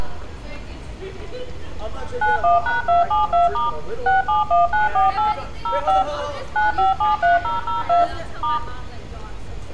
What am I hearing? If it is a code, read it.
DTMF, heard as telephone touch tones, dialled by machine, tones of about 150 ms, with room echo and street noise. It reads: 91#272* 671948 05 9573002 *